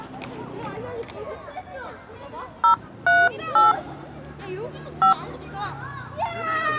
DTMF, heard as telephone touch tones, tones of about 160 ms, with the noise of a residential street. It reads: 038 5